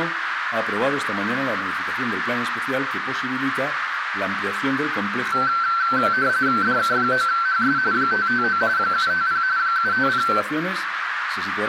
RTTY (45.45 baud, 170 Hz shift), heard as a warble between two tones, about 1440 Hz centre, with radio static and a narrow filter. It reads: DK9HS 559 750 750